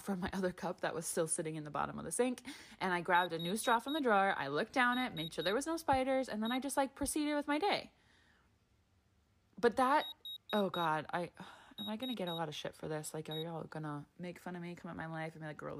Beep code, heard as a piezo beeper, played twice, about 3800 Hz, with speech in English. 4-3-1. In Phoenix BIOS tables: memory failure above the first 64 KB.